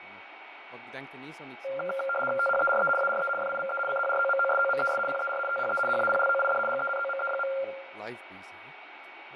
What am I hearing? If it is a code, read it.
RTTY (75 baud, 850 Hz shift), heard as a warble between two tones, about 960 Hz centre, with radio static, a steady whistle near 2250 Hz, room echo and speech in Dutch. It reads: THERE ARE FIVE CHROMOSOMES PER THE HAPLOID GENOME.